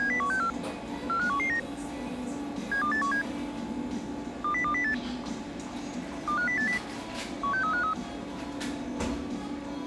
Five-tone selective call (CCIR), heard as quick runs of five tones, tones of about 100 ms, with the noise of a cafe. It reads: 70164 45119 72817 20208 25080 16353